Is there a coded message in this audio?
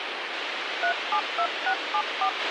Yes: DTMF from 0.8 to 2.3 s, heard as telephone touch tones, dialled by hand, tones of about 80 ms, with radio hiss and a squelch burst at the end. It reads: 372674